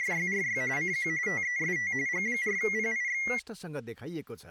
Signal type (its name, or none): RTTY